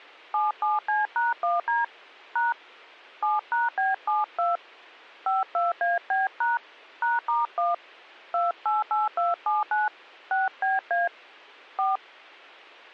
DTMF, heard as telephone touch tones, dialled by hand, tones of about 170 ms. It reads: 77C#1D # 7#B72 52AB# #*1 288279 6BA 4